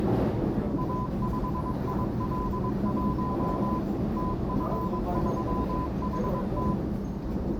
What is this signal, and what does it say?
Morse code, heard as a keyed tone, machine-sent, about 22 wpm, 1010 Hz, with the noise inside a subway train. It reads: A5IL1 TF3HT